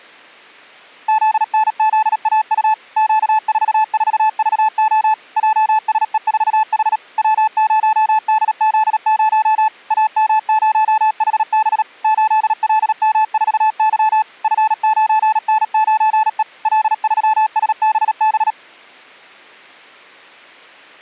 Morse code, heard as a keyed tone, machine-sent, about 37 wpm, 870 Hz. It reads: ZNZAU Q44VO JSE4H W0DZ0 AM0HB 8LM4Y F9N9E L3SBB